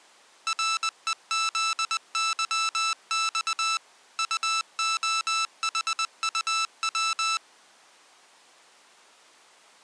Morse code, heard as electronic beeps, machine-sent, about 20 wpm, 1320 Hz. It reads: REZYX UOHUW